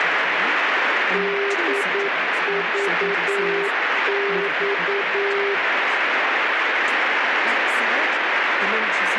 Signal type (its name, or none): Morse code